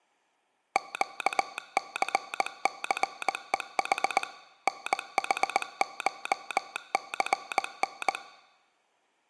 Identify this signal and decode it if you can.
Morse code (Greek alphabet), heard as a telegraph sounder, machine-sent, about 19 wpm. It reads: ΨΘΘΕΗ ΝΗΧΘΝ